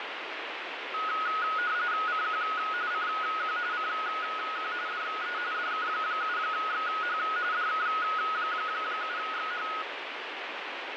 RTTY (45.45 baud, 170 Hz shift), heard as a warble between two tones, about 1360 Hz centre, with radio static. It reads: CQ CQ CQ DE DK7XH DK7XH